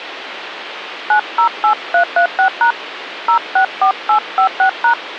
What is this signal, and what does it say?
DTMF, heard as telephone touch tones, dialled by hand, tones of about 100 ms, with phone line noise. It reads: 908336# 064856#